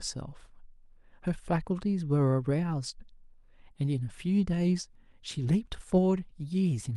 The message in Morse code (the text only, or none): none